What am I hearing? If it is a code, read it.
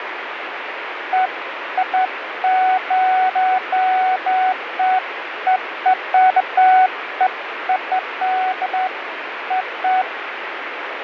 Beeps of irregular length, with radio static. There is no code.